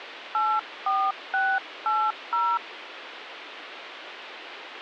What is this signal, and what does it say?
DTMF, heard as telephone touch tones, dialled by hand, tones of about 250 ms, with phone line noise. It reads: 84680